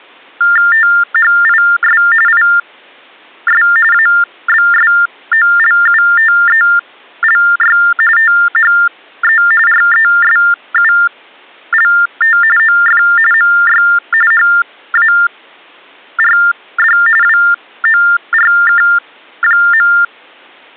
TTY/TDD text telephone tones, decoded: THIS IS ABSOLUTELY THE RESULT OF MY HARD WORK.

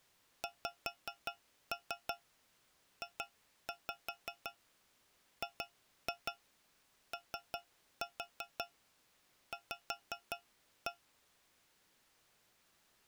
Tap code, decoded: XJGOV

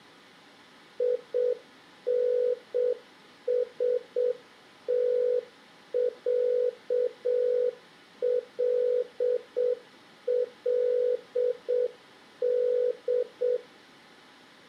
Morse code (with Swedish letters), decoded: INSTÄLLD

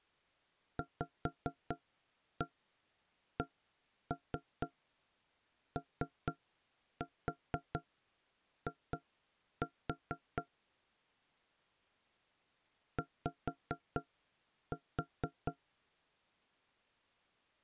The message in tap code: VCOI Y

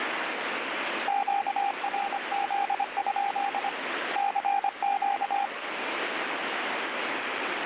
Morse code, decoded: QRZ? CQ

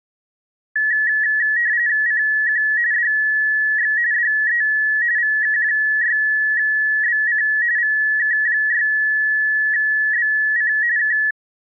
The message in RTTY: CQ DX DE VK6BC VK6BC K

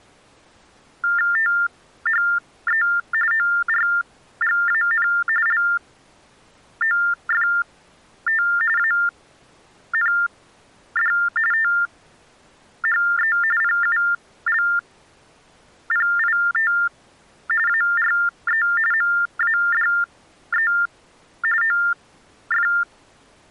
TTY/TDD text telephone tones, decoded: THE ORGAN LOFT AND THE PULPIT ARE MADE OF

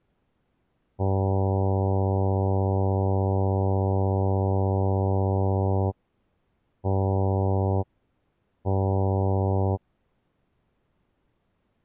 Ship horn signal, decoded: 1 long, 2 short

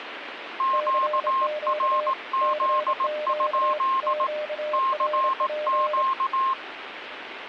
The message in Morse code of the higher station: QRZ? CQ

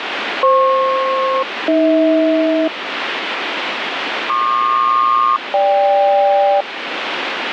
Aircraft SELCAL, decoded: FP-AH PQ-GK

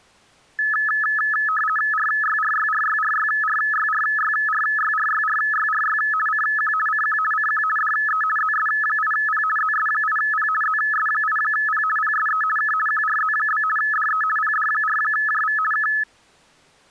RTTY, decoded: RYRYRYRYRYRYRYRYRYRY CQ CQ CQ DE ZS8P ZS8P ZS8P PSE K QRZ? DE PD4JV K

